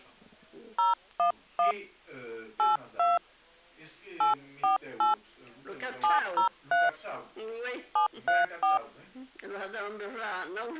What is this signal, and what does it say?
DTMF, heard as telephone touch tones, dialled by hand, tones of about 140 ms. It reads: 011 82 848 703 734